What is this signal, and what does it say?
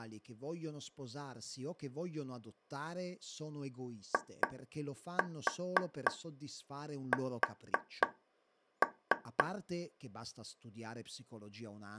Tap code, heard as taps on a table, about 3 knocks a second, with speech in Italian. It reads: IS